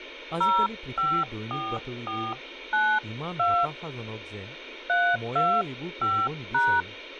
DTMF, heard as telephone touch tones, dialled by hand, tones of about 260 ms, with speech in Assamese. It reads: 054492 325#